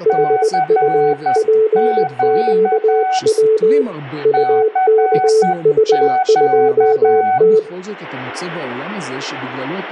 Morse code, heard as two keyed tones, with room echo and speech in Hebrew. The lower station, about 20 wpm, 440 Hz: HUPQW UKH2T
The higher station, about 10 wpm, 750 Hz: CQ CQ